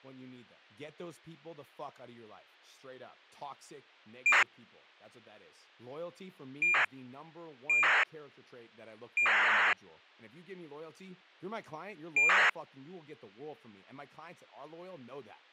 ACARS aircraft data, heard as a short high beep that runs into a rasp, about 2400 baud, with speech in English.